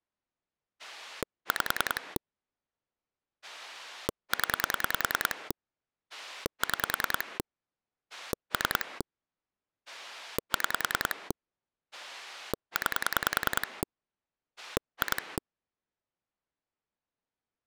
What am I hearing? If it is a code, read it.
Pulse dialling, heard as a rotary dial, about 10 pulses a second. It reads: 5 0 6 3 6 9 2